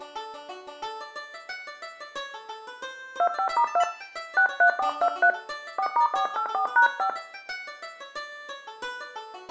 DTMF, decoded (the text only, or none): 25*2 63423 4*484#5